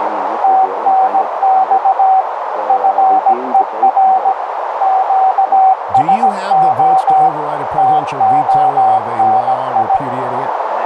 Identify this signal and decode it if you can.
Morse code, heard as a keyed tone, machine-sent, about 17 wpm, 760 Hz, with heavy radio static and a narrow filter. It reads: TNX FER QSO TONI